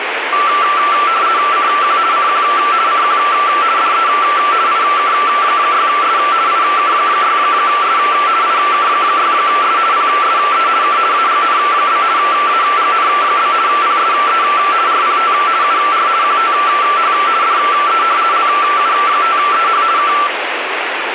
RTTY (50 baud, 170 Hz shift), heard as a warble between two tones, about 1250 Hz centre, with radio static. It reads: CQ CQ CQ DE IK6S IK6S IK6S PSE K AGN? AGN? PSE RPT UR QTH DE LU5EH K